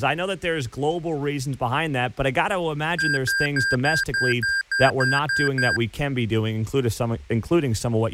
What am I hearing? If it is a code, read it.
Beep code, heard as beeps from a small speaker, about 1600 Hz, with speech in English. 10 short. In AMI BIOS tables: CMOS shutdown register error.